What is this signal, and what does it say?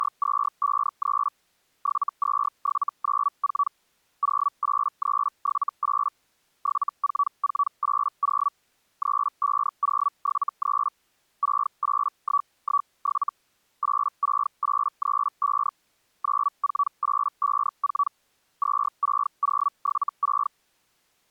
Hellschreiber (Feld-Hell, 122.5 baud), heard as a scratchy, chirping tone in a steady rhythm, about 1140 Hz. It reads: … 72794 08378 74480 35073 68117 86835 94854 26076